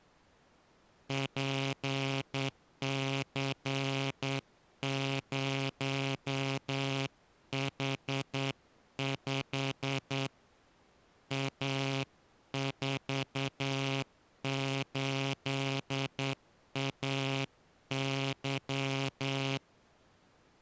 Morse code, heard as a buzzer, hand-sent with a straight key, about 9 wpm. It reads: PC0H5 A48AY